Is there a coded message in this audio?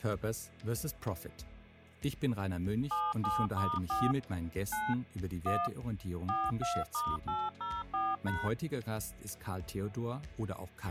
Yes: DTMF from 2.9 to 8.5 s, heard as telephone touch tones, dialled by machine, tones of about 220 ms, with a squelch burst at the end. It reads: 77*4 9 1 42*804#